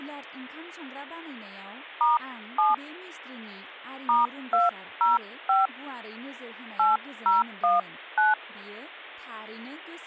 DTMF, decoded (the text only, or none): *7 *205 8019